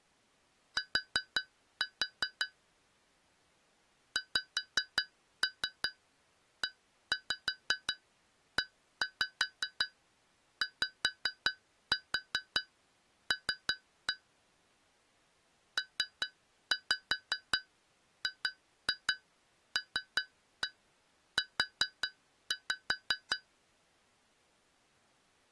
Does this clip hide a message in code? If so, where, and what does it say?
Yes: tap code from 0.8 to 23.5 s, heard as taps on glass, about 5 knocks a second. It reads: T XEEYL PGLU